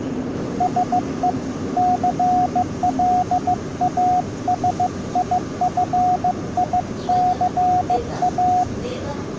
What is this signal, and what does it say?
Morse code, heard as a keyed tone, hand-sent with a bug key, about 15 wpm, 730 Hz, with the noise inside a subway train. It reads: SE CLASIFICA